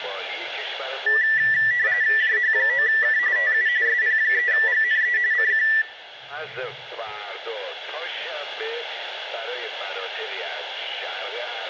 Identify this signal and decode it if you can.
RTTY (45.45 baud, 170 Hz shift), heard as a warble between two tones, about 1850 Hz centre. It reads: JH9K TU SP3GNE CQ